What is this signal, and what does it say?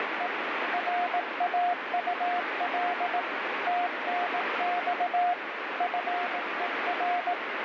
Morse code, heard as a keyed tone, machine-sent, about 18 wpm, 710 Hz, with heavy radio static. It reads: … RAUL TNX FER